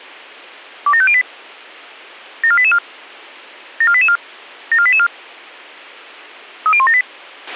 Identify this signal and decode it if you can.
Five-tone selective call (ZVEI), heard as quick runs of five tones, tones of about 70 ms, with a squelch burst at the end. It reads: 27508 74884 74884 74884 30178